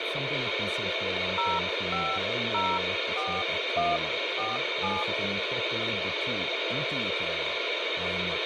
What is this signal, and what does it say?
DTMF, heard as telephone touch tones, dialled by hand, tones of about 190 ms, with radio hiss and speech in English. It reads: 0504147